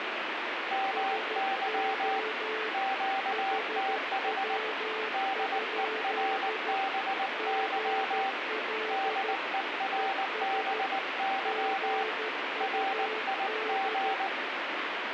Morse code, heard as two keyed tones, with radio static. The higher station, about 19 wpm, 780 Hz: MY QTH DERBY DERBY RIG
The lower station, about 13 wpm, 440 Hz: SO HW? GL ES GUD